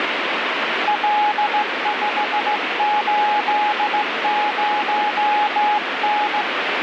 Morse code, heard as a keyed tone, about 16 wpm, 840 Hz, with radio static. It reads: L580N